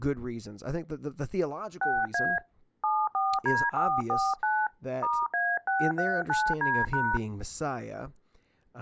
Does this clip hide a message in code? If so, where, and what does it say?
Yes: DTMF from 1.8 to 7.2 s, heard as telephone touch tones, dialled by hand, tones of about 240 ms, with speech in English. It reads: 6A 74D449 *A639D#